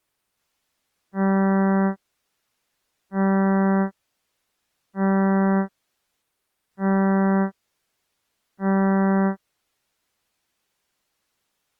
Ship horn signal, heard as a ship's horn, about 190 Hz. 5 short. At sea: I doubt that you are doing enough to avoid a collision.